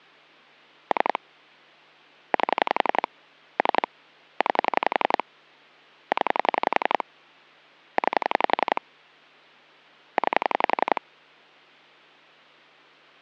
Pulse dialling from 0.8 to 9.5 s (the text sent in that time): 3 8 3 9 0 9